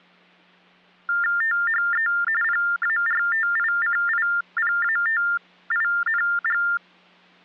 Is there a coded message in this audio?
Yes: TTY/TDD text telephone tones (45.45 baud Baudot) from 1.1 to 6.8 s, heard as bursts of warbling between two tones, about 400 Hz shift, 1600 Hz centre. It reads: THE PARTICIPATING